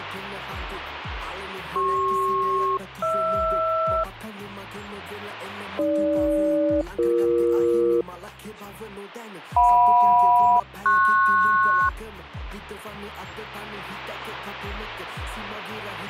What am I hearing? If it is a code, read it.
Aircraft SELCAL, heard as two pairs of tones, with radio static. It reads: CP-HR AG-BE JM-PS